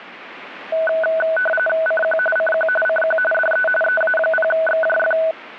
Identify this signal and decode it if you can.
RTTY (45.45 baud, 850 Hz shift), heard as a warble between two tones, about 1070 Hz centre, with radio static. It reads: CQ CQ CQ DE EA0XJF